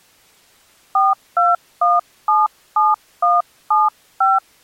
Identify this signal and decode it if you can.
DTMF, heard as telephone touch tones, dialled by hand, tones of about 180 ms. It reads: 42177175